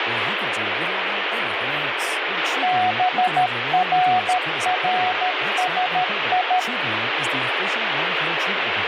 Morse code (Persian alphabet), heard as a keyed tone, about 13 wpm, 730 Hz, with heavy radio static and speech in English. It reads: بررسی